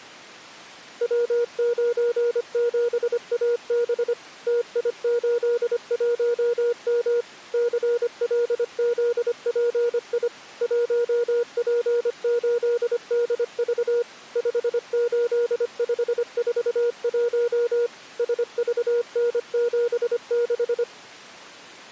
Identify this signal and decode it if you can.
Morse code, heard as a keyed tone, machine-sent, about 25 wpm, 480 Hz. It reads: W97AB TI81M CLZPI 1P8DV 58541 SVN76